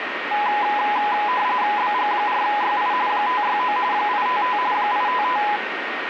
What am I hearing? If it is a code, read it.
RTTY (45.45 baud, 170 Hz shift), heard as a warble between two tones, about 920 Hz centre, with radio static and a steady whistle near 1860 Hz. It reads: BG4YI 569 855 855